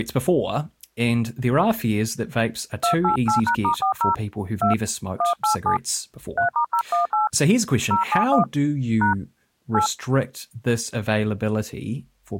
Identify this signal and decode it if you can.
DTMF, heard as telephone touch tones, dialled by hand, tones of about 110 ms, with speech in English. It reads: 288#*40 2 187 3*018 071 # 8